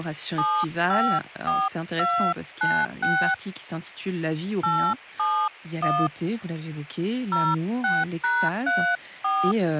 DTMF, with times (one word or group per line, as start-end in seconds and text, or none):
0.4-3.3 754296
4.6-6.1 871
7.3-9.5 06#34